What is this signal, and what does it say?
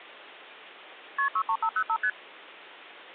Multi-frequency trunk signalling (R1, as on North American trunks), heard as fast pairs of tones, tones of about 70 ms. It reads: KP 63505 ST